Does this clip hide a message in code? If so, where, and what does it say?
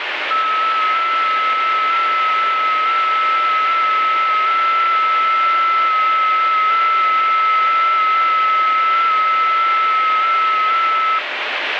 Yes: FT8 (several signals at once) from 0.3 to 11.2 s, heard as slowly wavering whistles, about 6.25 baud, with radio static.